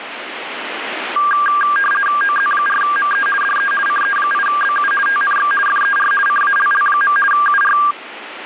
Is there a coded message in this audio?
Yes: RTTY (50 baud, 450 Hz shift) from 1.2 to 7.9 s, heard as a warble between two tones, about 1400 Hz centre, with radio static. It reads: OZ4ME DE CE8BU TNX FER CALL. UR